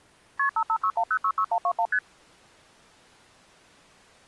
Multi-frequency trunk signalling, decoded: KP 5561066121 ST

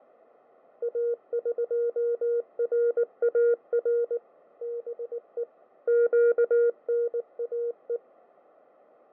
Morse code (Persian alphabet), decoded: اقرار به گناه

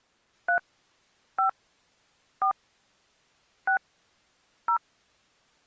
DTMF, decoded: 3 5 4 6 0

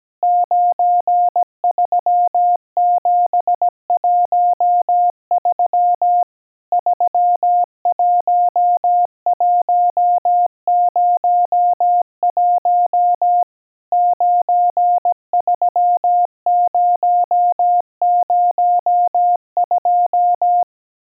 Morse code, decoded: 93713 31101 93002

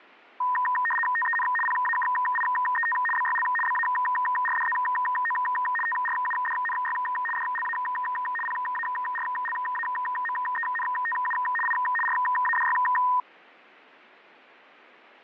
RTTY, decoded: TEN PAKIET BYL BARDZO TRUDNY DLA PARLAMENTU I RADY

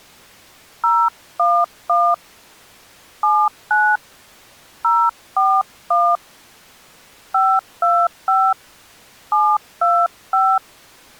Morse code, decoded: none

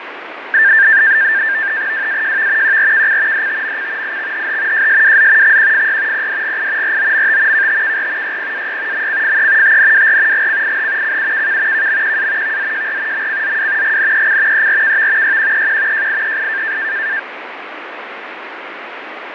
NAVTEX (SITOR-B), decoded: WAJV QRKC DTMC IXHH JSWZ XQFY PDGI ROMT KTKR YPAY MCFE TNWR GCIH CUKK KMQA VZJR MCZW GNEC ERKV YQEQ JIEI

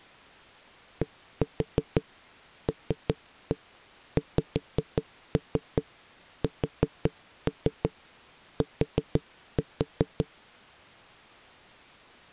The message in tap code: DLXST

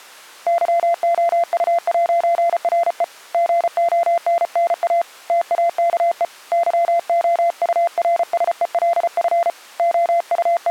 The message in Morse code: YOU'RE GONNA TAKE YOURSELF …

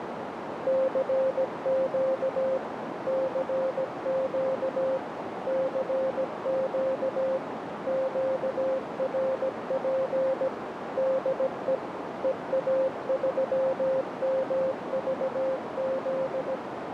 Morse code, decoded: CQ CQ CQ QRP DE EA3MVZ

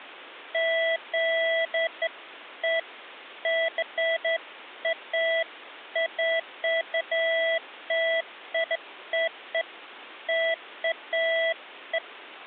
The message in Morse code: none

